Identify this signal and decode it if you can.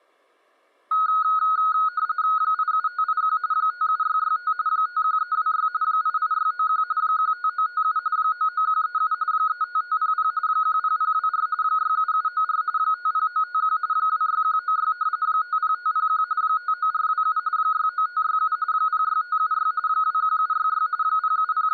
RTTY (45.45 baud, 170 Hz shift), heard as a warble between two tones, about 1360 Hz centre. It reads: 87581 57665 51326 88691 15957 99137 35500 10024 67794 50951 26196 50501 59427 69567 06576 21766 …